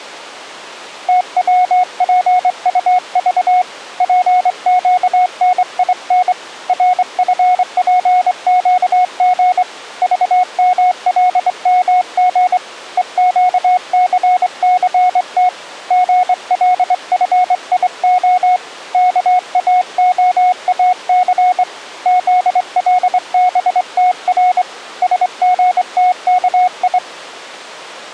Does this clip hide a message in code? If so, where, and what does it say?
Yes: Morse code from 1.0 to 27.0 s, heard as a keyed tone, hand-sent with a straight key, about 24 wpm, 730 Hz. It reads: TWPUV PQNIN RFPQG VMLMG EQCCT GLFIO KAOAC ZLBTR SGTKI